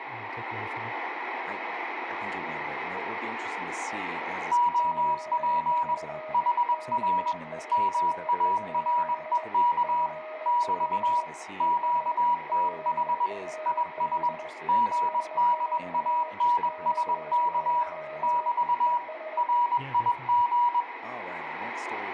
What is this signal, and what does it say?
Morse code, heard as two keyed tones, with radio static, room echo and speech in English. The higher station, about 21 wpm, 970 Hz: OP HR MAREK <BT> QTH IS GDANSK <BT> RIG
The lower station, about 21 wpm, 620 Hz: OK KEES? GL ES GUD DX 73 ES